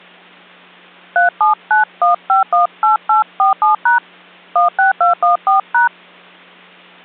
DTMF, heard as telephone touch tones, dialled by hand, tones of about 130 ms. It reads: 3791518847# 16214#